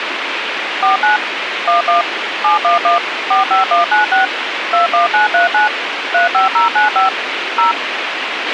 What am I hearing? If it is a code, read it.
DTMF, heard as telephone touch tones, dialled by machine, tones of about 130 ms, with radio hiss and a squelch burst at the end. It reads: 49 11 711 45196 21939 35095 0